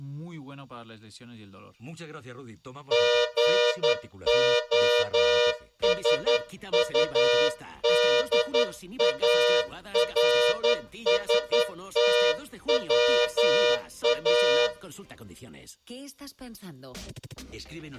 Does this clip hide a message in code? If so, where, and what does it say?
Yes: Morse code (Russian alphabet) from 2.9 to 14.7 s, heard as a horn, hand-sent with a straight key, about 11 wpm, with room echo. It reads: ГОСУДАРСТВА